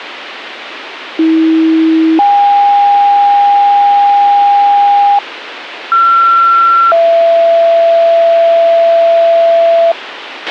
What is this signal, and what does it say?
Two-tone page, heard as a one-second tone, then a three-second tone, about 320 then 810 Hz, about 1360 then 670 Hz, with radio hiss and a squelch burst at the end.